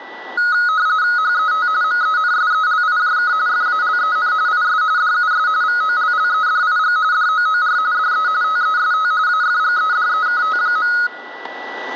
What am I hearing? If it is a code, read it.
RTTY (45.45 baud, 170 Hz shift), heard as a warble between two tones, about 1360 Hz centre, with static crashes and a steady whistle near 1960 Hz. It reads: HET MENSELIJK FALEN IS DUS VOLLEDIG DOOR DE TEST AFGEDEKT.